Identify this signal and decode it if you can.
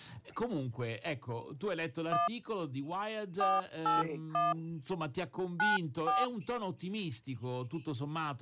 DTMF, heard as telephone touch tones, dialled by hand, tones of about 150 ms. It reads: 1 481 94